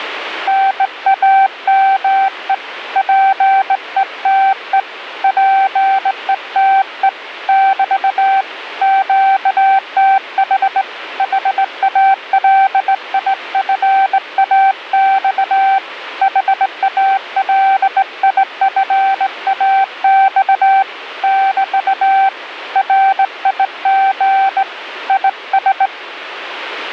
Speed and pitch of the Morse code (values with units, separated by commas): 18 wpm, 780 Hz